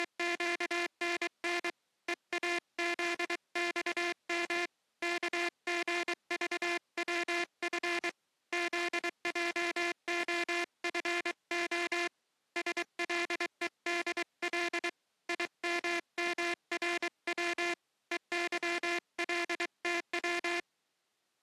Morse code, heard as a buzzer, hand-sent with a paddle, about 23 wpm. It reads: … EAZXM KGVWF ZJOFO SLEDL IMMRW EYLTW